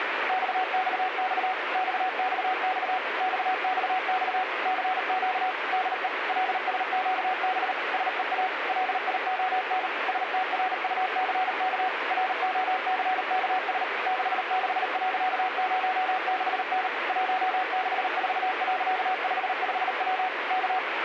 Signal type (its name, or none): Morse code